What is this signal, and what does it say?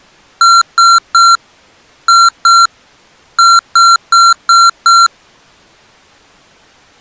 Beep code, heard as beeps from a small speaker, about 1370 Hz. 3-2-5.